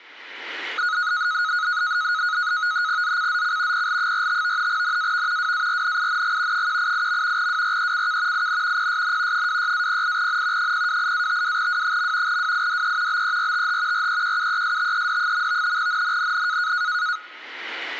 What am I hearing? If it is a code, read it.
NAVTEX (SITOR-B), 100 baud, 170 Hz shift, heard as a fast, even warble, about 1360 Hz centre. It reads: ZCZC PL45 NAV WARNING 188. WRECK IN PSN 26-08N 028-52W. WIDE BERTH REQUESTED. NNNN